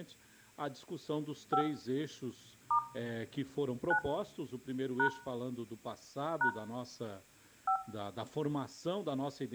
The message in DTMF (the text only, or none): 5 * 9 # # 5